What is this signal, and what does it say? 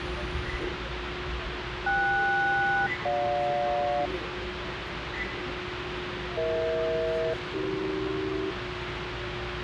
Aircraft SELCAL, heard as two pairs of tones, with radio hiss and the noise inside a subway train. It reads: KS-GJ EH-AC